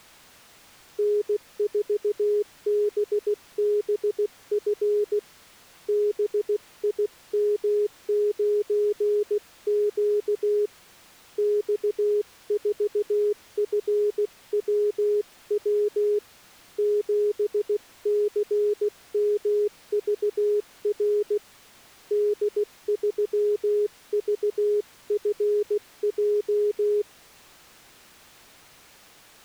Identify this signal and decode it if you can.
Morse code, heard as a keyed tone, hand-sent with a paddle, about 16 wpm, 420 Hz. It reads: N4BBF BIM9Q X4FWW 7CMVR D3VFJ